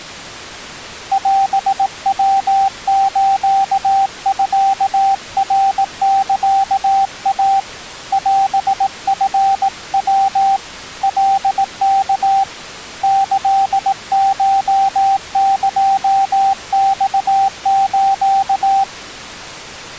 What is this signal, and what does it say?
Morse code (Japanese Wabun code), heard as a keyed tone, hand-sent with a paddle, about 18 wpm, 780 Hz. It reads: オヤスミナサイ オチヤ カワ キコエマス